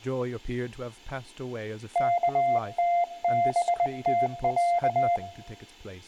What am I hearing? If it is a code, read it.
Morse code (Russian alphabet), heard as a keyed tone, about 20 wpm, 700 Hz, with room echo and speech in English. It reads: КТБТЯ